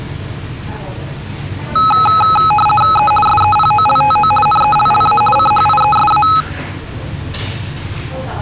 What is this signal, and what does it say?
RTTY (50 baud, 450 Hz shift), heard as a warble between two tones, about 1070 Hz centre, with the noise of a restaurant. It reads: E SEPOLTO NELLA CHIESA